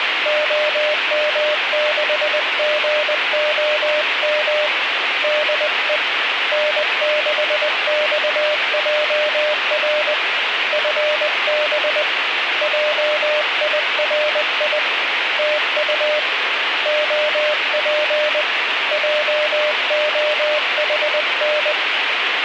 Morse code, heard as a keyed tone, hand-sent with a paddle, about 20 wpm, 600 Hz, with radio static. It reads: OM6GOM DE N6XJR FB JIRI TU OP JOHN